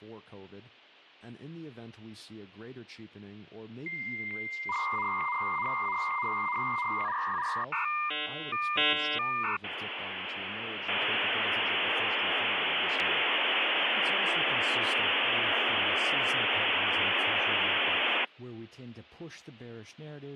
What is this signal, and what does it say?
Dial-up modem handshake (V.34 or later), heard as a whistle, warbles, then hiss, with speech in English.